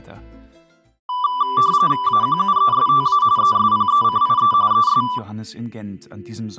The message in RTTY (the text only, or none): AQUESTA ESPECIE ES